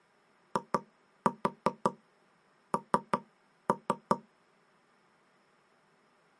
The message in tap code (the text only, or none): IN